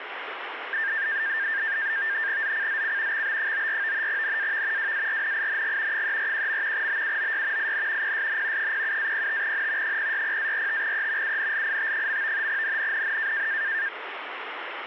NAVTEX (SITOR-B), 100 baud, 170 Hz shift, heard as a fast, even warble, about 1700 Hz centre, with radio static. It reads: ZCZC XB94 NAV WARNING 341. BUOY IN PSN 07-05N 060-45E UNLIT. NNNN